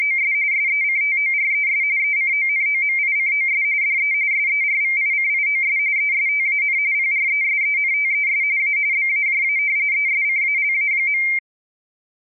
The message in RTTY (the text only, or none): … SECTORES ECONOMICOS DE SERVICIOS ESTAN PRESENTES A BAJA ESCALA.